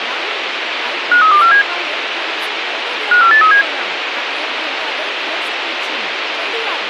Five-tone selective call (CCIR), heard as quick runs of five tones, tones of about 100 ms, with radio hiss and speech in Maithili. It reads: 53247 54837